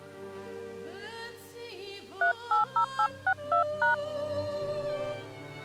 DTMF, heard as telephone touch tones, dialled by hand, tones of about 100 ms. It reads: 380862#